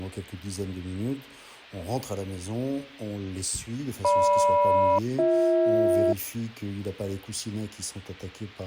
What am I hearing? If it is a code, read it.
Aircraft SELCAL, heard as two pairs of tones. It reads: GM-BH